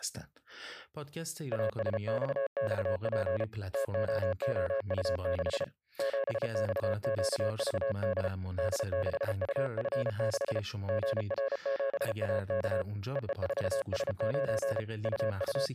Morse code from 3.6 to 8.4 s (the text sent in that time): TOOU6 7XQVD